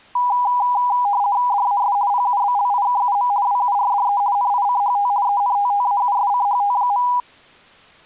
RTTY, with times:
1.5-2.0 DAS
2.1-3.3 PUBLIKUM
3.5-4.2 WURDE
4.4-5.1 NICHT
5.3-7.1 ENTTAUSCHT.

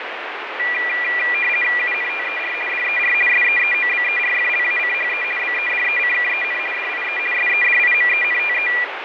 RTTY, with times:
1.8-2.5 UNTER
2.7-3.1 DER
3.3-5.2 SEEOBERFLACHE
5.4-6.6 BEDECKEN
6.7-7.2 DIE
7.3-8.7 SEDIMENTE

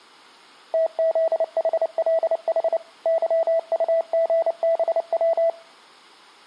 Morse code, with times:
0.7-2.8 TZHLH
3.1-5.5 YUGBW

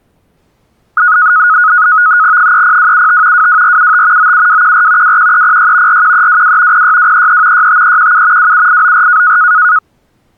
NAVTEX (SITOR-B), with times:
2.4-3.5 30275
3.3-4.3 22475
4.2-5.2 97214
5.0-6.0 21306
5.9-6.8 41322
6.7-7.7 06233
7.5-8.5 65317
8.4-9.4 27894

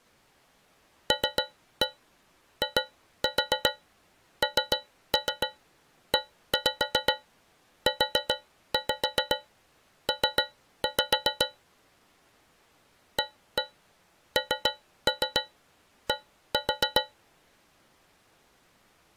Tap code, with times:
1.1-11.5 LINEUP
13.2-17.0 AND

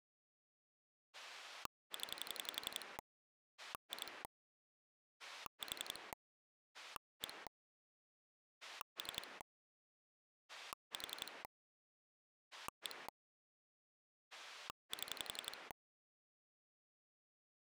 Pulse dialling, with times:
1.1-3.0 0
3.6-4.2 2
5.2-6.1 4
6.7-7.5 1
8.6-9.4 3
10.5-11.4 4
12.5-13.1 1
14.3-15.7 7

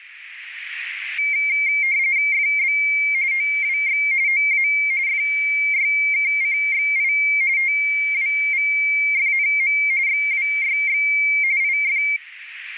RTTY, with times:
2.3-2.8 FB
3.3-4.0 OWX
4.3-4.7 OA
5.1-7.1 FYKCXI
7.6-9.8 TWVFNM
10.1-11.0 XWYX
11.6-12.0 IF

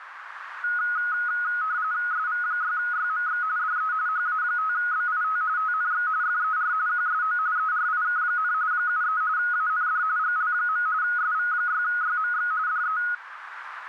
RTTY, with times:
2.1-3.4 SV6YMX
3.6-3.9 DE
4.1-5.4 HA5BIT
5.6-6.1 TNX
6.2-6.7 FER
6.9-7.4 QSO
7.6-8.5 ERIK,
8.7-9.2 73
9.4-10.0 AND
10.2-10.9 GL.
11.0-12.5 SV6YMX
12.7-13.0 DE

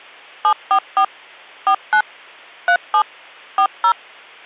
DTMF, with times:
0.4-1.0 744
1.7-2.0 49
2.7-3.0 37
3.6-3.9 40

